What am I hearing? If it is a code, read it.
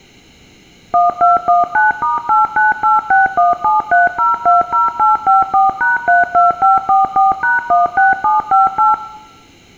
DTMF, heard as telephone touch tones, dialled by machine, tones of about 160 ms, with room echo. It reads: 1219*8986173020854#32544#16758